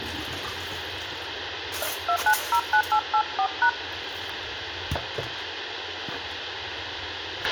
DTMF, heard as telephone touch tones, dialled by hand, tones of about 80 ms, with radio hiss, a squelch burst at the end and kitchen noise. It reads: 2909884#